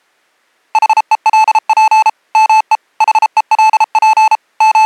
Morse code, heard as electronic beeps, machine-sent, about 33 wpm, 870 Hz. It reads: HELP ME HELP …